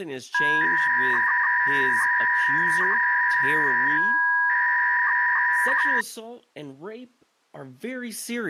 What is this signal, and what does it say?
300-baud modem data (V.21 tones), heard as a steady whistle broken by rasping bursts, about 300 baud, 200 Hz shift, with speech in English.